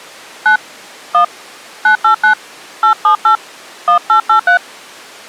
DTMF, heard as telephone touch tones, dialled by hand, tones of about 100 ms. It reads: 9 1 989 878 1883